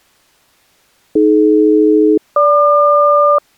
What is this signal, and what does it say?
Aircraft SELCAL, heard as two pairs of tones. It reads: AD-GQ